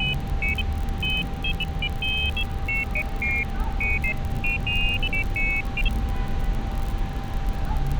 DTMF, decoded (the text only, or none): none